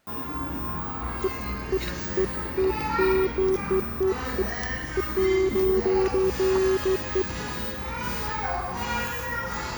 Beeps of irregular length, with the noise of a restaurant. There is no code.